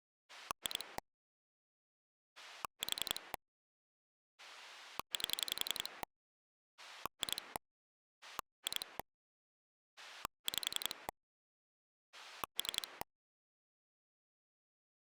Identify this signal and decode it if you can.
Pulse dialling, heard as a rotary dial, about 11 pulses a second. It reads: 2 4 8 2 2 5 3